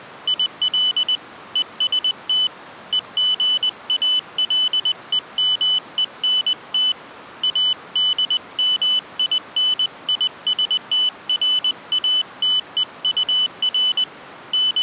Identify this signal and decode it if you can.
Morse code, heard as a high beeper, hand-sent with a paddle, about 20 wpm, 3000 Hz. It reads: IL EST EGALEMENT ADMINISTRATEUR …